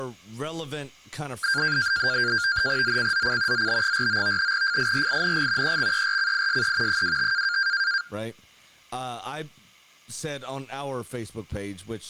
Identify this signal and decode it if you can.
NAVTEX (SITOR-B), 100 baud, 170 Hz shift, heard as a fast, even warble, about 1500 Hz centre, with speech in English. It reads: ZCZC ZB49 FIRING EXERCISE 25